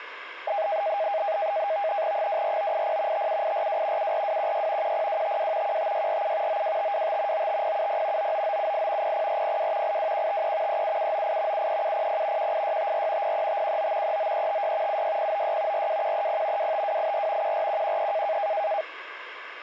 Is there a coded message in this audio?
Yes: NAVTEX (SITOR-B), 100 baud, 170 Hz shift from 0.5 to 18.8 s, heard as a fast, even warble, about 720 Hz centre. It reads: 24980 57842 74216 10252 15647 92525 95070 99978 00402 82153 37798 73700 18654 03519 39356 76096 42130 25284 14113